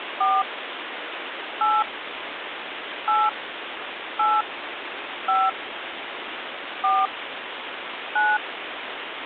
DTMF, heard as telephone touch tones, dialled by hand, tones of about 220 ms, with phone line noise. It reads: 4 8 8 8 5 4 9